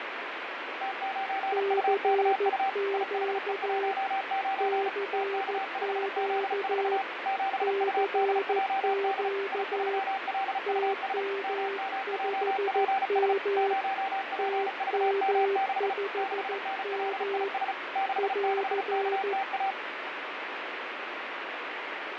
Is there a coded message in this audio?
Yes: Morse code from 0.8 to 19.8 s, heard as two keyed tones, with radio static. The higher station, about 35 wpm, 780 Hz: T9UKU IHE19 TK5Z4 7UDJD I3LUS MMJPS 0PVM6 6NLIS 66KTA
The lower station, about 14 wpm, 400 Hz: CQ CQ CQ TM5M TM5M <AR>